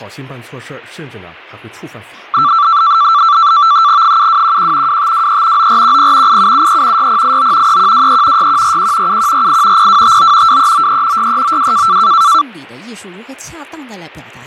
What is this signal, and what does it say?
NAVTEX (SITOR-B), 100 baud, 170 Hz shift, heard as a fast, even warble, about 1250 Hz centre. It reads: 7211 2523 9410 8773 6089 3123 6141 7148 0259 2393 6392